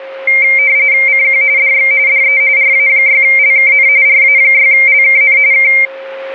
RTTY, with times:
1.1-1.4 CQ
1.6-1.9 DX
2.1-2.4 DE
2.6-3.9 RA6LKN
4.1-5.4 RA6LKN
5.5-5.7 K

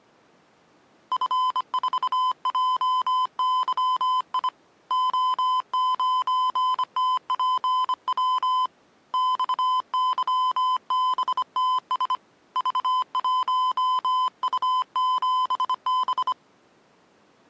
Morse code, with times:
1.1-4.5 F4JYI
4.9-8.7 O9TPW
9.1-12.1 XYBTS
12.6-16.3 V1U7B

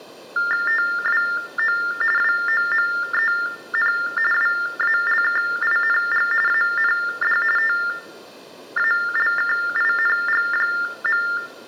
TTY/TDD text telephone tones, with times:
0.7-1.8 TWO
2.2-3.9 WOMEN
4.3-6.3 WALKING
6.5-7.4 AND
7.6-11.2 TALKING.

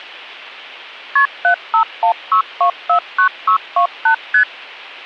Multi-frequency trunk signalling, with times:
1.2-1.3 KP
1.4-4.1 7516249628
4.3-4.4 ST

